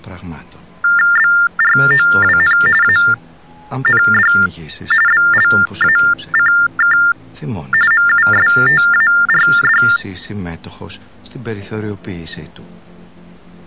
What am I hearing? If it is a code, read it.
TTY/TDD text telephone tones (45.45 baud Baudot), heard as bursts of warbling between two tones, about 400 Hz shift, 1600 Hz centre. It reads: BROWN AND BLACK MUSTARD